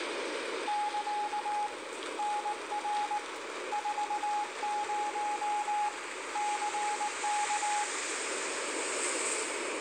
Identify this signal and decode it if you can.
Morse code, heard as a keyed tone, hand-sent with a paddle, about 19 wpm, 840 Hz, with radio static, room echo and street noise. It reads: <KA> NR 40 CK